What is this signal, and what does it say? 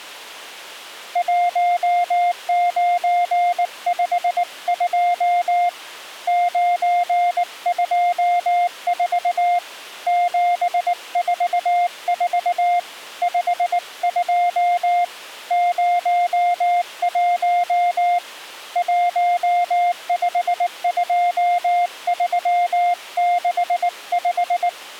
Morse code, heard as a keyed tone, hand-sent with a paddle, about 19 wpm, 700 Hz. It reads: 1952 924 744 52 01 152365